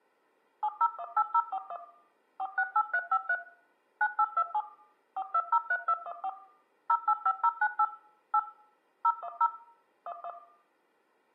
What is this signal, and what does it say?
DTMF, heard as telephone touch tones, dialled by machine, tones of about 60 ms, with room echo. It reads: 7018041 468353 9827 4203214 085098 8 010 11